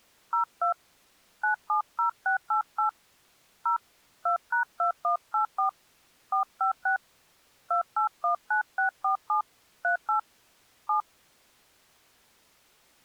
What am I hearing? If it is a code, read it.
DTMF, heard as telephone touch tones, dialled by hand, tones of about 110 ms. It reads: 02 970688 0 2#2184 456 2819647 38 7